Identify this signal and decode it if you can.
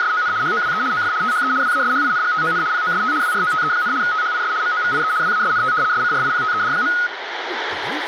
RTTY (75 baud, 170 Hz shift), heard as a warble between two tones, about 1360 Hz centre, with radio static and speech in Nepali. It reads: … HOWE OF THE WASHINGTON POST WROTE, THIS MOVIE WASNT SCRIPTED.